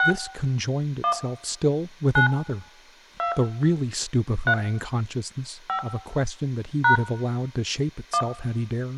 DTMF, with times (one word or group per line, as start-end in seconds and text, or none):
0.0-0.1 6
1.0-1.1 1
2.2-2.3 9
3.2-3.3 2
4.5-4.5 3
5.7-5.8 5
6.8-7.0 #
8.1-8.2 1